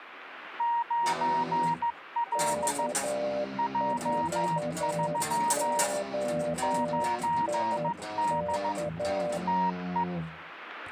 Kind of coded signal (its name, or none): Morse code